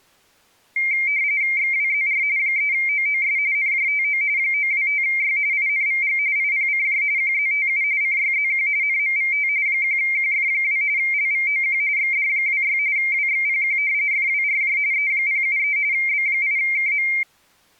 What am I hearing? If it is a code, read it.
RTTY (45.45 baud, 170 Hz shift), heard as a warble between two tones, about 2200 Hz centre. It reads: XWZR 3OOS NJTO 925Y INVG IPCJ QZTU CYZQ NMVT 1QF2 LVOQ XD26 WXPQ FWRJ E073 B8KM